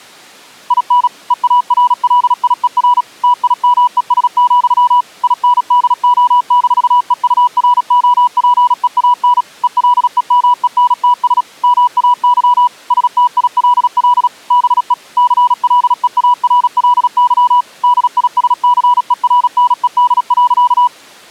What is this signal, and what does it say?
Morse code, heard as a keyed tone, machine-sent, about 36 wpm, 980 Hz. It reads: IN EARLIER TIMES, INDO-EUROPEAN ELEMENTS MAY STILL BE CLEARLY DISCERNED.